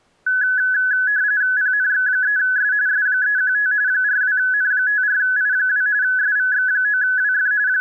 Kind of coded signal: RTTY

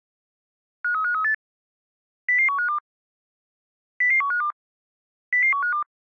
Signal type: five-tone selective call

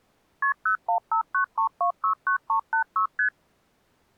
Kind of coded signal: multi-frequency trunk signalling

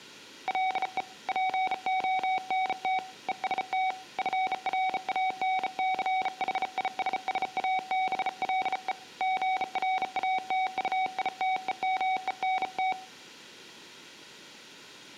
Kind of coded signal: Morse code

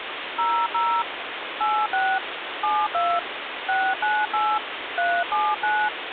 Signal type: DTMF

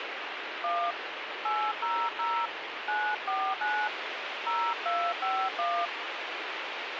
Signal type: DTMF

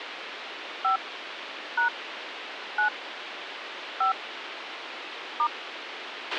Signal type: DTMF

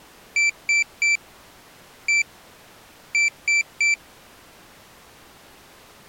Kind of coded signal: beep code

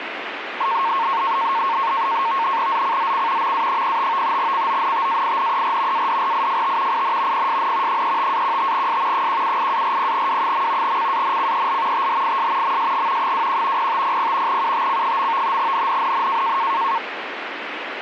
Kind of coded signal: NAVTEX (SITOR-B)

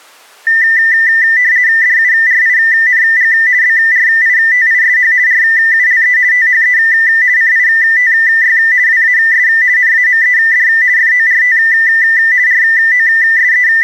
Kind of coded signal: RTTY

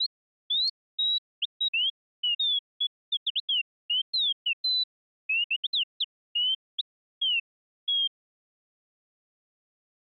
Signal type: none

